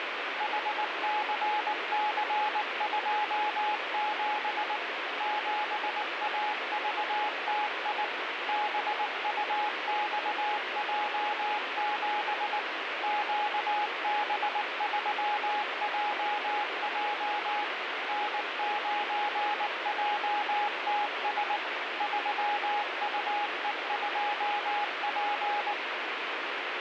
Morse code, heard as a keyed tone, machine-sent, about 19 wpm, 840 Hz, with heavy radio static. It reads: HCC27 7AVTI BUXJ7 QB3JJ N9JTS 3UE2P